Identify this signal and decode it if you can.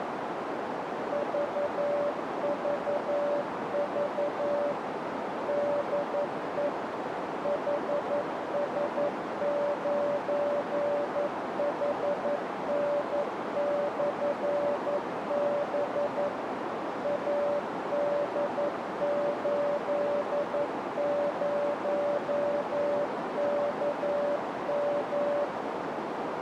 Morse code, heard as a keyed tone, machine-sent, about 11 wpm, 580 Hz, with heavy radio static and a narrow filter. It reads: VVV DE HS9HN/B AD80KM